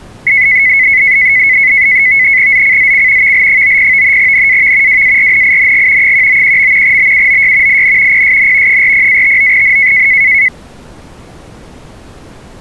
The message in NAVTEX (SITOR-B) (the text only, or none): ZCZC VL90 NAV WARNING 191. BUOY IN PSN 40-59N